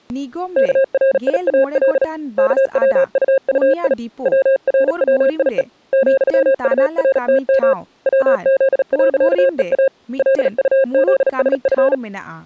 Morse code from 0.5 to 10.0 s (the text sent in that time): KRIAL KWUUI WRWIE ,URTM WZ.EA